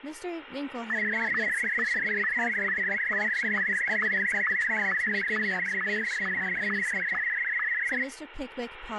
SSTV (slow-scan television), Martin M1, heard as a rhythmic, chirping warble, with radio static and speech in English.